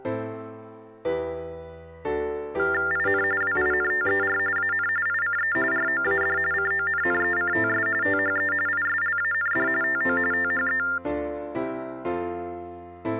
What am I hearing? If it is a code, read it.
TTY/TDD text telephone tones (45.45 baud Baudot), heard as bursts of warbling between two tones, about 400 Hz shift, 1600 Hz centre. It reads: IN WINTER AN ICE ROAD CONNECTS THE ISLAND TO THE